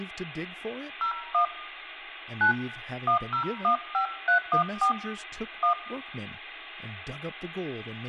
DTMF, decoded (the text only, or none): 01 9 1015314 1